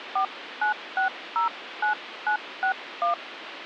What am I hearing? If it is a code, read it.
DTMF, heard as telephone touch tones, dialled by hand, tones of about 100 ms, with phone line noise. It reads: 49609961